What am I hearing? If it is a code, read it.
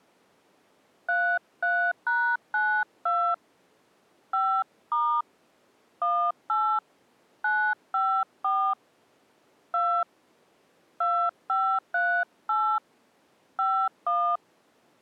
DTMF, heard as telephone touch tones, dialled by hand, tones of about 290 ms. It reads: 33#92 5* 18 954 2 2538 51